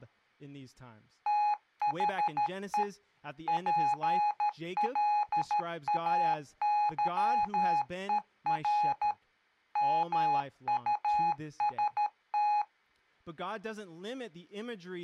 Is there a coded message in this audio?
Yes: Morse code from 1.2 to 12.7 s, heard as electronic beeps, machine-sent, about 13 wpm, 840 Hz, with speech in English. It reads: THE PLAYER MUST